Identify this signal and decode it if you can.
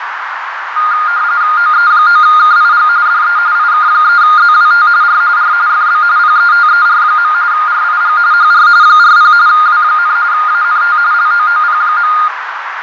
RTTY (45.45 baud, 170 Hz shift), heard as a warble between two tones, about 1320 Hz centre, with radio static, fading and a narrow filter. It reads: OE9KIG DE IK3ZWT R R FB PETER. RIG HR 40 W, ANT LOOP.